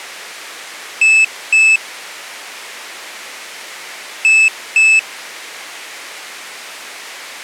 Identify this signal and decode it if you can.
Beep code, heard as a piezo beeper, played twice, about 2600 Hz. 2 short. In AMI BIOS tables: memory parity error; in IBM BIOS tables: self-test error shown on screen; in Dell tables: no memory detected.